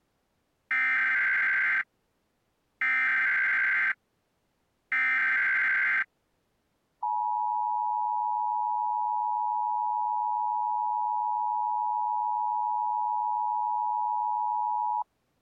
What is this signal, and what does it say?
Emergency Alert System (SAME) tones (header bursts, then the 853 and 960 Hz attention tone), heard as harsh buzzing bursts, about 520.83 baud.